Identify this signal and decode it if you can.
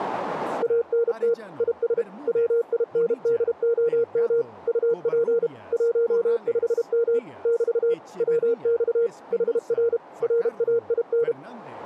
Morse code, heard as a keyed tone, machine-sent, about 32 wpm, 470 Hz. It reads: ANT IS WINDOM UP 15M <BT> WX HR RAIN